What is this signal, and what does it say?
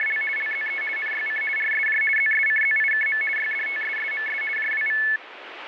RTTY (50 baud, 450 Hz shift), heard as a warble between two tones, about 1950 Hz centre, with radio static. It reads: … LZE NYC RSJ ZSCZIKM YDTSSMS JWV